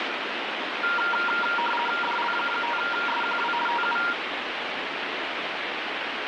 RTTY (50 baud, 450 Hz shift), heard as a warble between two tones, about 1170 Hz centre, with radio static. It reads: DL5SQW TU